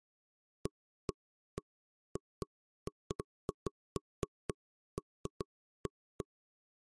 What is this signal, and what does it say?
Irregular knocks on wood. There is no code.